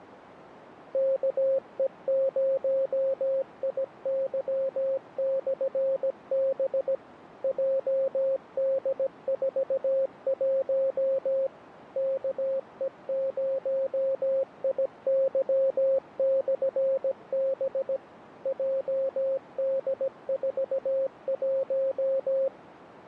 Morse code, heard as a keyed tone, machine-sent, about 17 wpm, 540 Hz, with radio static. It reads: KE0IY/B JD41 KE0IY/B JD41